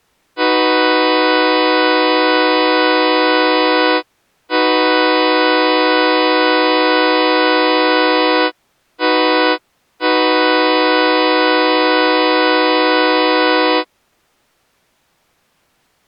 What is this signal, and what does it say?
Train horn signal, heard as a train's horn. 2 long, 1 short, 1 long. On North American railways: approaching a public crossing.